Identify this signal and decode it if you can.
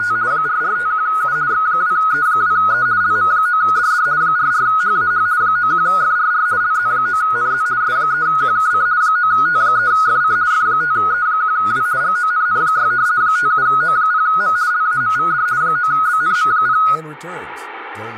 RTTY (50 baud, 170 Hz shift), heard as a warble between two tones, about 1360 Hz centre, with radio static, room echo and speech in English. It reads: … 4451U X2E2E LM9DD 44HAH 91FRR LZ9NZ S3QKC 9T3FC F5E1W GONN6 57O0M LAMVD 9BNM0